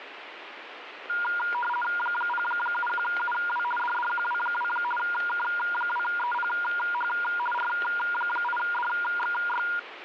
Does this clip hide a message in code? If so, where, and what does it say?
Yes: RTTY (50 baud, 450 Hz shift) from 1.1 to 9.8 s, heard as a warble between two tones, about 1190 Hz centre, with radio static. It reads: 071UW DDQW2 K2EPH R8DXY